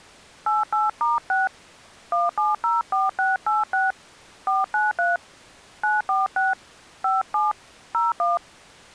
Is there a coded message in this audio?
Yes: DTMF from 0.5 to 8.4 s, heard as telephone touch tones, dialled by hand, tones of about 170 ms. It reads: 88*6 1704686 493 946 57 01